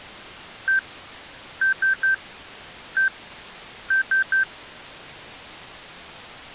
Beep code, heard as beeps from a small speaker, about 1550 Hz. 1-3-1-3. In Phoenix BIOS tables: keyboard controller test failure.